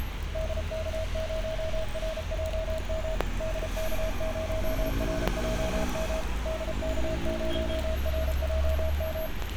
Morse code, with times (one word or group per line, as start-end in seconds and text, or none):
0.3-3.1 DK0RJM
3.4-6.2 DK0RJM
6.5-9.3 DK0RJM